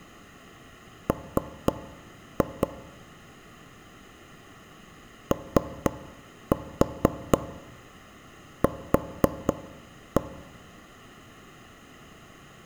Tap code, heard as knocks on wood, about 4 knocks a second, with room echo. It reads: M OQ